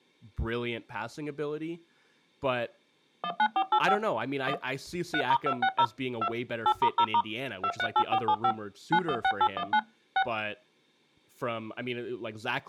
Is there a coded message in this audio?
Yes: DTMF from 3.2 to 10.2 s, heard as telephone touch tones, dialled by machine, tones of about 70 ms, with speech in English. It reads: 19485 1 3*260 2 8*0* 238475 916819 6